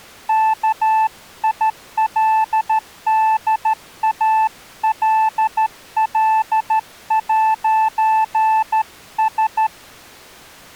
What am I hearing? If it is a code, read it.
Morse code, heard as a keyed tone, hand-sent with a straight key, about 13 wpm, 880 Hz. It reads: KILDALL'S